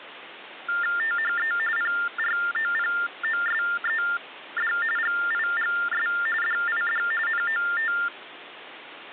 TTY/TDD text telephone tones (45.45 baud Baudot), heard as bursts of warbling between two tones, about 400 Hz shift, 1600 Hz centre, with phone line noise. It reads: THE PROPOSED GIGS DID NOT